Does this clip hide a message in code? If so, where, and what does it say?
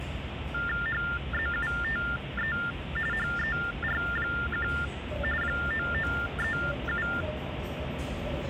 Yes: TTY/TDD text telephone tones (45.45 baud Baudot) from 0.5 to 7.2 s, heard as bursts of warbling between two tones, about 400 Hz shift, 1600 Hz centre, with phone line noise and the noise of a subway station. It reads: HZUTE HER1 9937